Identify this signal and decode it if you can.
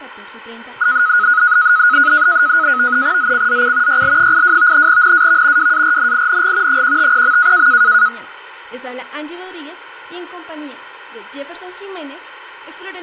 NAVTEX (SITOR-B), 100 baud, 170 Hz shift, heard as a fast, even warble, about 1360 Hz centre, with radio static. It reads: ZCZC YL82 NAV WARNING 150.